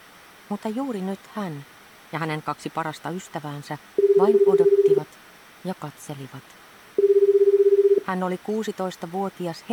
Telephone call progress tone (Japanese plan), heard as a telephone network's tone, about 380, 400, 420 Hz, 1 s on and 2 s off. Ringback tone.